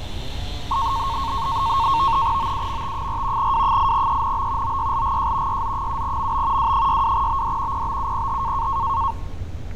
NAVTEX (SITOR-B), 100 baud, 170 Hz shift, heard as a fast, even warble, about 1000 Hz centre, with fading, static crashes and street noise. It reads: OUMT4 W8ENB OYLGJ YZ7MB W62BD PBUPH